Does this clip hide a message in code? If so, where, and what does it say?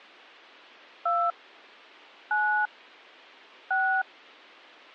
Yes: DTMF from 1.1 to 4.0 s, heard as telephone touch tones, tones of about 280 ms. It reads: 2 9 6